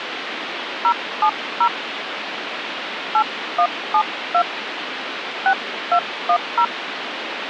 DTMF, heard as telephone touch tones, dialled by hand, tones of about 80 ms, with phone line noise. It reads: 070 8172 6210